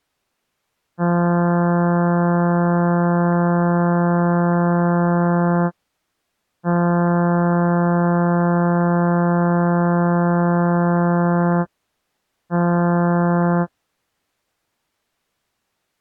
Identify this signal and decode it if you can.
Ship horn signal, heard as a ship's horn, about 170 Hz. 2 long, 1 short. At sea: I intend to overtake on your starboard side.